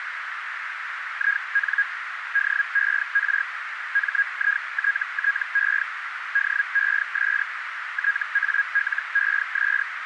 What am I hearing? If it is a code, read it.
Hellschreiber (Feld-Hell, 122.5 baud), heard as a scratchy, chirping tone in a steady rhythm, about 1650 Hz, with radio static and a narrow filter. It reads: IN DER MITTE DES TALES